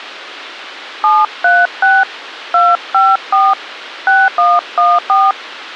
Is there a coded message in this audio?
Yes: DTMF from 1.0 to 5.3 s, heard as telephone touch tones, dialled by hand, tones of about 210 ms, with a squelch burst at the end. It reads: 736 254 6114